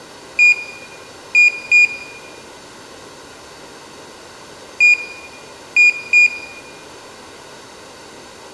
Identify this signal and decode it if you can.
Beep code, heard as a piezo beeper, played twice, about 2450 Hz, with room echo. 1-2.